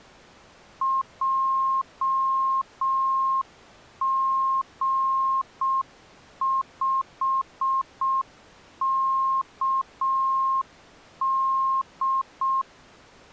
Morse code, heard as a keyed tone, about 6 wpm, 1070 Hz. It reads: JG5KD